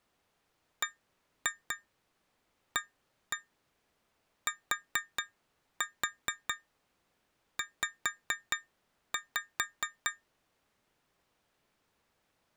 Tap code, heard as taps on glass, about 4 knocks a second. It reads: BATZ